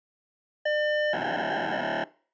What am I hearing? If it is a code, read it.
POCSAG pager data (1200 baud), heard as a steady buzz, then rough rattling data.